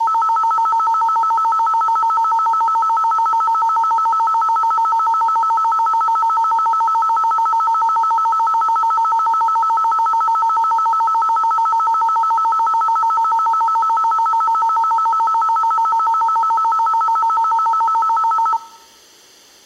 A tone that alternates evenly between two pitches. There is no code.